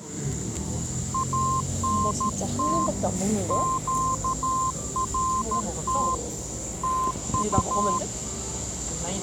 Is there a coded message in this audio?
Yes: Morse code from 1.1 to 8.0 s, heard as a keyed tone, hand-sent with a paddle, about 13 wpm, 1040 Hz, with the noise of a cafe. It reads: ANT QRT TU